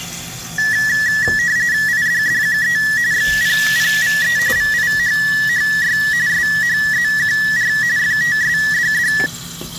RTTY (45.45 baud, 170 Hz shift), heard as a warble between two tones, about 1800 Hz centre, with kitchen noise. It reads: IDDQE XPPVE VIHHY SHZQR FTSDD